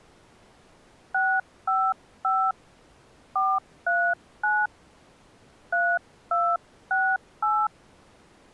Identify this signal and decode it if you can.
DTMF, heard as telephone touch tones, dialled by hand, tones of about 240 ms. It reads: 655 439 3268